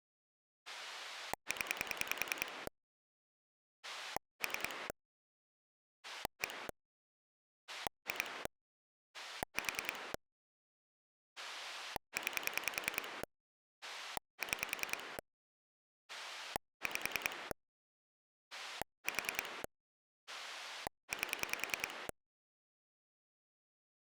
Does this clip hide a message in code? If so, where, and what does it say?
Yes: pulse dialling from 0.7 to 22.1 s, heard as a rotary dial, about 10 pulses a second. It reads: 0 3 1 2 4 9 6 5 4 8